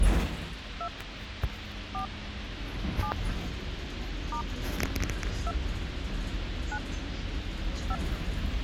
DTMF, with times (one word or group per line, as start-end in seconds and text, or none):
0.8-0.9 2
1.9-2.1 4
3.0-3.1 7
4.3-4.4 *
5.5-5.5 2
6.7-6.8 9
7.9-8.0 5